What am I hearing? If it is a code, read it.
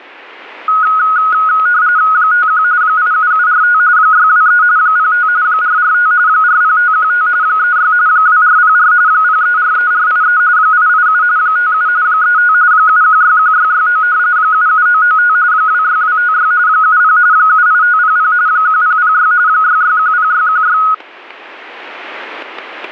RTTY (45.45 baud, 170 Hz shift), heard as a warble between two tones, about 1360 Hz centre, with static crashes. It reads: 51 87745 623 05 445 40515 36 2404 0343483 887 57 35 7161669 77995 26256 70 78500 1006 6610616